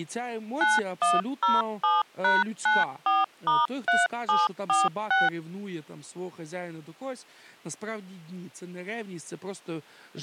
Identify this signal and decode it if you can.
DTMF, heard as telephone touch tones, dialled by machine, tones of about 180 ms, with speech in Ukrainian. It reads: 9107#94*3746